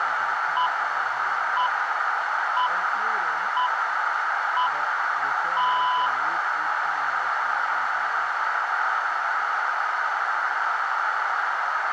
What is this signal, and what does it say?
Radio time signal (six pips, as the Greenwich Time Signal), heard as pips, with radio static, a narrow filter and room echo.